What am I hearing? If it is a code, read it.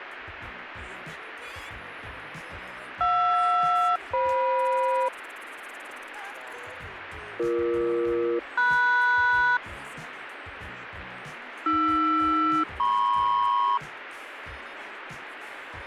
Aircraft SELCAL, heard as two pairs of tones, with radio static. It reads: JR-FM BE-MS AR-MP